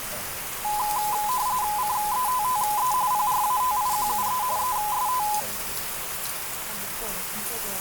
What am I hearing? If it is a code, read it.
RTTY (45.45 baud, 170 Hz shift), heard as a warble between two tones, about 920 Hz centre, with radio static and the noise of a restaurant. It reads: CETTE PRATIQUE EST